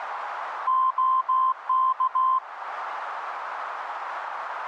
Morse code, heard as a keyed tone, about 16 wpm, 1040 Hz, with radio static. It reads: OK